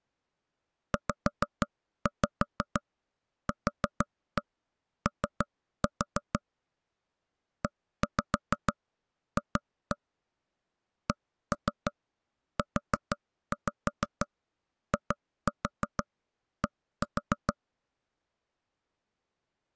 Tap code, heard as taps on a table, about 6 knocks a second. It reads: ZQO EF CUID